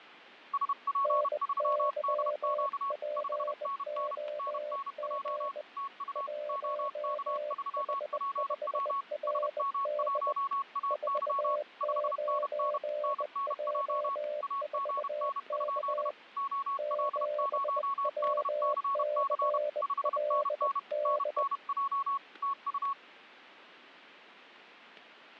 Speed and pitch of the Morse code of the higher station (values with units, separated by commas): 31 wpm, 1110 Hz